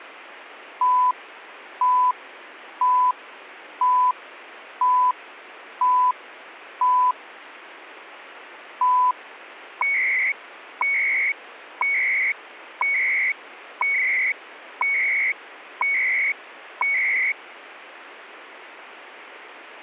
Radio time signal (CHU, Canada), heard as beeps and data bursts, one a second, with radio static.